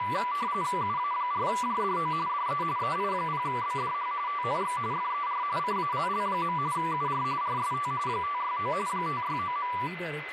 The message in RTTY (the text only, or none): UA4JDO DE EI0BDH TNX FER CALL. UR RST 569 569.